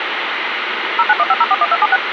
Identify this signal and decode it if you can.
DTMF, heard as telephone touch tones, dialled by machine, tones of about 40 ms, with phone line noise. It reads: 0915041276